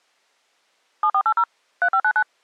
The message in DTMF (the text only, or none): 7480 3599